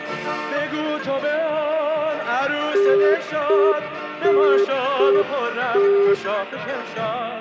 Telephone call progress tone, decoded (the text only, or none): congestion tone